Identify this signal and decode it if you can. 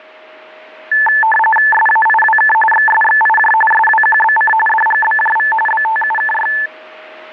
RTTY (45.45 baud, 850 Hz shift), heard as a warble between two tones, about 1310 Hz centre, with radio static and a steady whistle near 630 Hz. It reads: SAIWK XSXIJ SWQBC DGBJV BTUKY